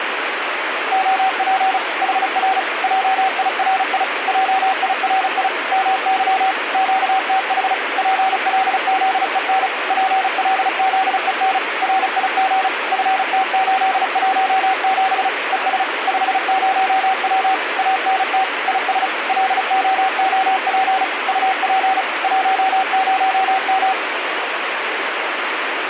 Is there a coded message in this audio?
Yes: Morse code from 0.9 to 24.0 s, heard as a keyed tone, machine-sent, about 35 wpm, 760 Hz, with radio static. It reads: OP HR JIRI JIRI MY QTH PLZEN PLZEN RIG FT817 ES 50W ANT IS LOOP UP 10M